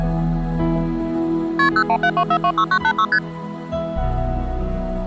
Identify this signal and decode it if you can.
Multi-frequency trunk signalling (R1, as on North American trunks), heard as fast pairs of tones, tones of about 70 ms. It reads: KP 0172426986 ST